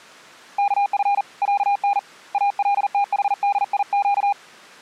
Morse code (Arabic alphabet), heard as a keyed tone, hand-sent with a paddle, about 40 wpm, 810 Hz. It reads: كف عن التحديق